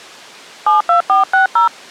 DTMF, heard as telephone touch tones, dialled by hand, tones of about 120 ms. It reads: 72460